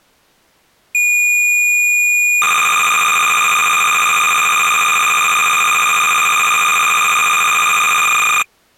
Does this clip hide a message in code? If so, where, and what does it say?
Yes: cassette data (Kansas City type), 300 baud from 0.9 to 8.4 s, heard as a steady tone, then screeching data.